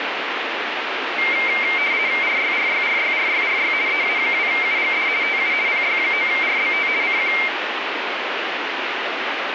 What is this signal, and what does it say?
RTTY (50 baud, 170 Hz shift), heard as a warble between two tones, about 2200 Hz centre, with radio static. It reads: RYRYRYRYRY EA2UGD TU PY9RBT CQ